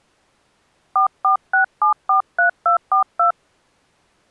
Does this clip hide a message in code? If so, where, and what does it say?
Yes: DTMF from 1.0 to 3.3 s, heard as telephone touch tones, dialled by hand, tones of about 110 ms. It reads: 446743242